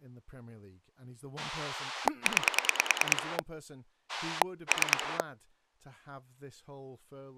Pulse dialling, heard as a rotary dial, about 9 pulses a second, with speech in English. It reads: 9 3